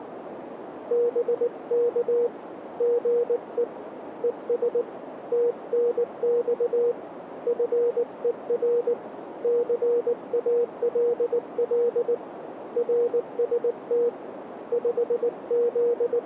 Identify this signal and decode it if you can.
Morse code, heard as a keyed tone, hand-sent with a paddle, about 19 wpm, 480 Hz, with radio static and a narrow filter. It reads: BK GE ES TNX FER CALL RST …